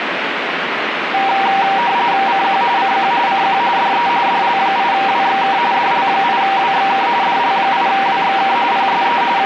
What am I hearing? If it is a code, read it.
RTTY (45.45 baud, 170 Hz shift), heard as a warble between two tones, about 870 Hz centre, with radio static. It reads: CQ CQ CQ DE DL8WXK DL8WXK DL8WXK PSE …